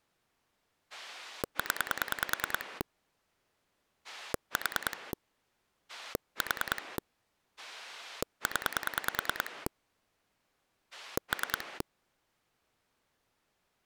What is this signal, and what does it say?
Pulse dialling, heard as a rotary dial, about 10 pulses a second. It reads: 0 4 4 0 3